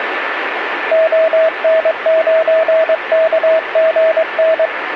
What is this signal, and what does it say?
Morse code, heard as a keyed tone, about 22 wpm, 640 Hz, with radio static and a steady whistle near 1760 Hz. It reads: ON9KGN